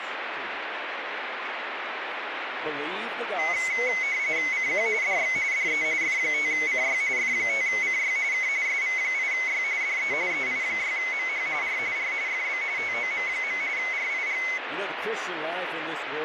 RTTY (45.45 baud, 170 Hz shift), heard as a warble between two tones, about 2150 Hz centre, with radio static. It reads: CQ DX DE F5CY F5CY K SV8Y DE EI6MH R R FB TOM. RIG